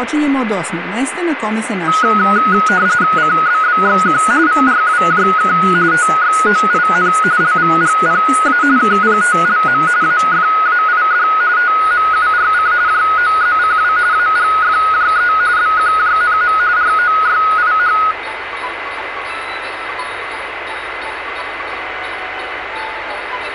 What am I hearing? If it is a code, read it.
RTTY (45.45 baud, 170 Hz shift), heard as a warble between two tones, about 1360 Hz centre, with radio static and a steady whistle near 2040 Hz. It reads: CBBXQ VRWJK TXOIN LVGPA KPTLM AFAID TMURC JOZCW AGFJE BQJNM ROYIH